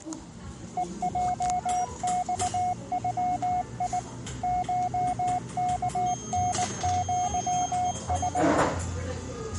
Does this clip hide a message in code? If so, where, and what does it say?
Yes: Morse code (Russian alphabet) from 0.7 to 8.5 s, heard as a keyed tone, machine-sent, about 19 wpm, 720 Hz, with the noise of a cafe. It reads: ЕЙЬЮИ ШКНЪС